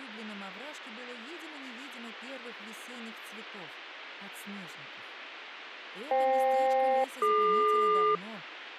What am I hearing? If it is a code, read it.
Aircraft SELCAL, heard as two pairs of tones. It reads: FK-DQ